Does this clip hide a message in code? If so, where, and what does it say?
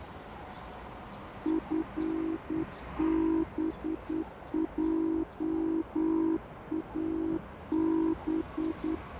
Yes: Morse code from 1.4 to 9.0 s, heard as a keyed tone, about 9 wpm, 320 Hz, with radio static and the noise of a park. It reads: FBJAB